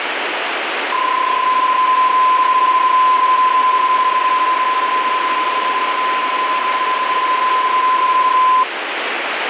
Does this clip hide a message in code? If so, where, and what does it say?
Yes: PSK31 (31.25 baud) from 0.9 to 8.6 s, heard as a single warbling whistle, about 1020 Hz, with radio static.